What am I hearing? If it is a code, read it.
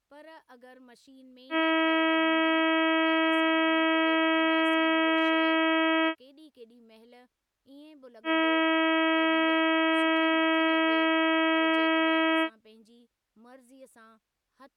Ship horn signal, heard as a ship's horn, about 320 Hz, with speech in Sindhi. 2 long. At sea: a vessel under power that has stopped in fog.